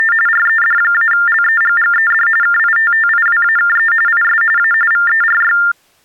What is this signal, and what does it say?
TTY/TDD text telephone tones (45.45 baud Baudot), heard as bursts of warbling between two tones, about 400 Hz shift, 1600 Hz centre. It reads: … RED-LEGGED KITTIWAKE IS A VERY